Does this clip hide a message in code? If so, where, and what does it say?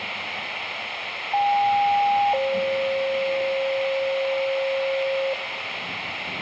Yes: two-tone page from 1.3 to 5.3 s, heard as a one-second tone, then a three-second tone, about 810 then 540 Hz, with radio hiss and room echo.